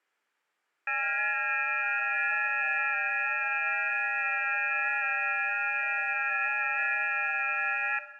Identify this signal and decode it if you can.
FT8 (several signals at once), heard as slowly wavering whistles, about 6.25 baud, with room echo.